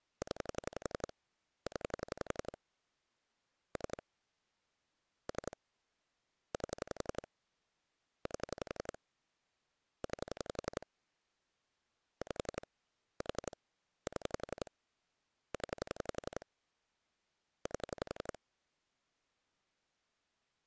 Pulse dialling, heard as clicks on a phone line, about 11 pulses a second. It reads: 0 0 3 3 8 8 9 5 4 7 0 8